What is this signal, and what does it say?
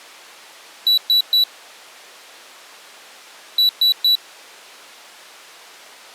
Beep code, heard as a piezo beeper, played twice, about 3950 Hz. 3 short. In AMI BIOS tables: failure in the first 64 KB of memory; in Dell tables: chipset error.